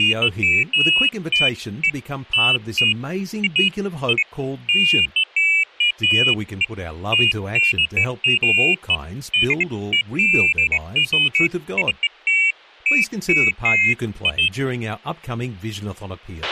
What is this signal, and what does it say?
Pairs of high tones at irregular times, with a squelch burst at the end and speech in English. There is no code.